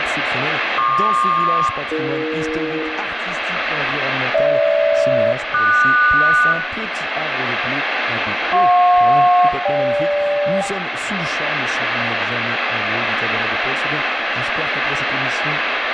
Aircraft SELCAL, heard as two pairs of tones, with radio static and room echo. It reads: PQ-AE GH-QS JP-GK